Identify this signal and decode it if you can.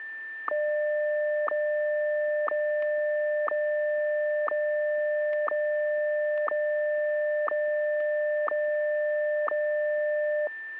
Radio time signal (WWVH, Hawaii), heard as ticks, one a second, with static crashes and a steady whistle near 1780 Hz.